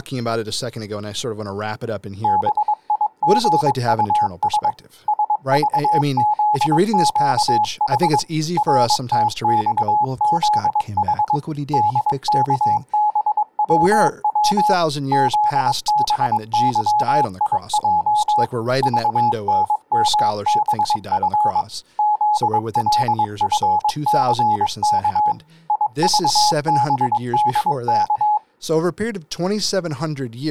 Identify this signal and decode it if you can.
Morse code, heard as a keyed tone, machine-sent, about 22 wpm, 840 Hz, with speech in English. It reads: BIGUS SVZQH RTXZH DKBWW ZBYIJ VNMBF ZLFCK IVBDK